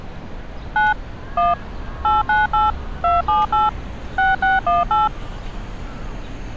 DTMF, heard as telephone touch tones, dialled by machine, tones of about 170 ms, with street noise. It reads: 9 1 898 278 6618